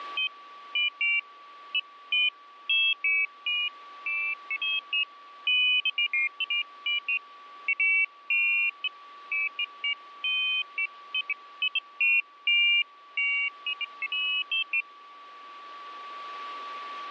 Pairs of high tones at irregular times, with a steady whistle near 1150 Hz. There is no code.